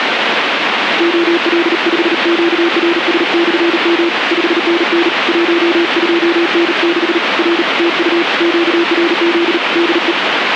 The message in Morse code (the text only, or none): OL5QRS/M 5NN 12N6 R TU QRZ DE